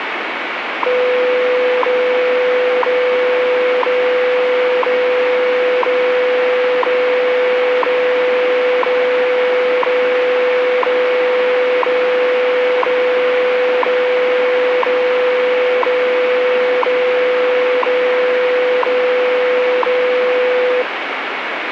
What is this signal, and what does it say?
Radio time signal (WWV, Colorado), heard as ticks, one a second, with radio static.